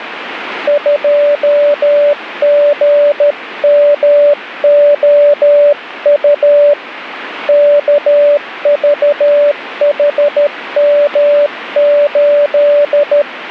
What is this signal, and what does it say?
Morse code, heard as a keyed tone, hand-sent with a paddle, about 13 wpm, 580 Hz, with radio static. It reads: 2GMOU KVHM8